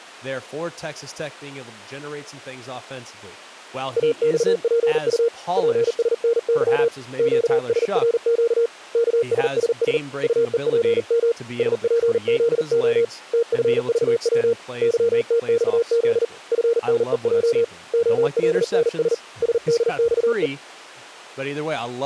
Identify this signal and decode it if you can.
Morse code, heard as a keyed tone, hand-sent with a paddle, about 39 wpm, 470 Hz, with speech in English. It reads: AXPU PSNY QSRQ KSSS UEPM SPZO TFVW YTXZ FNEJ OLNS SDXE